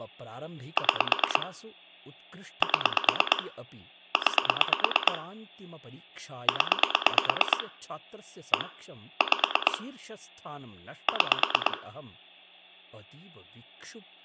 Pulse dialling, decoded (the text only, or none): 6 7 9 0 1 5 6